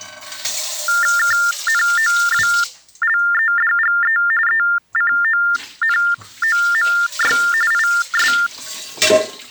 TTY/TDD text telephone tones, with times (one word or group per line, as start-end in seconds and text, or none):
1.2-4.2 KNOWLEDGE
4.5-7.4 ECONOMY
7.7-8.3 IS